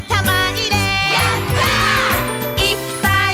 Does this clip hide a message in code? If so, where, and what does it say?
No.